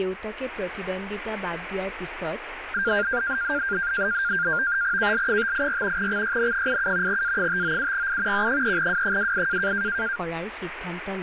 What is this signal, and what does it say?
NAVTEX (SITOR-B), 100 baud, 170 Hz shift, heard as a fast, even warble, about 1500 Hz centre, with radio static and speech in Assamese. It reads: KL584 XYN87 A597I Q3W28